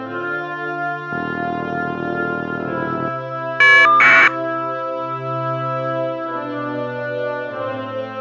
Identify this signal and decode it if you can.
Caller ID data burst, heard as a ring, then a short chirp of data, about 1200 baud.